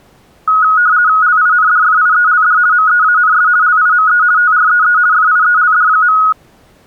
RTTY (50 baud, 170 Hz shift), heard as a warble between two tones, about 1360 Hz centre. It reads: LINDFIELD MEANS LIME TREE FIELD.